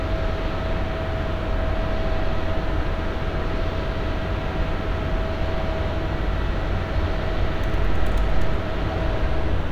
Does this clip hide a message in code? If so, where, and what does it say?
No, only street noise.